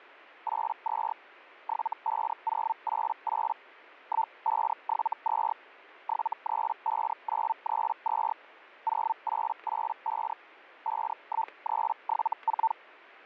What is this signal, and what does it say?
Hellschreiber (Feld-Hell, 122.5 baud), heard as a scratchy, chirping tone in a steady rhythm, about 900 Hz, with static crashes. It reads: 82 75088 1572 735932 0885 51374